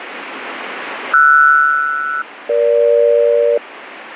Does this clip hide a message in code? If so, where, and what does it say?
Yes: aircraft SELCAL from 1.1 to 3.6 s, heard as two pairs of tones, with radio static. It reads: RS-EG